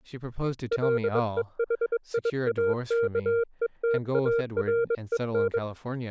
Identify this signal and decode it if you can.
Morse code, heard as a keyed tone, hand-sent with a bug key, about 22 wpm, 460 Hz, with speech in English. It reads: LEHIAKETAREN